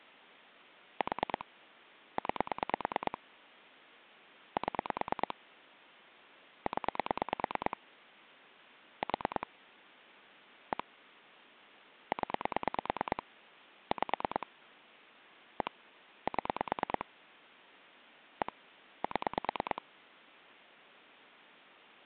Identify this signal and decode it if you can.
Pulse dialling, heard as clicks on a phone line, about 9 pulses a second. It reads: 4 9 7 0 4 1 0 5 1 7 1 7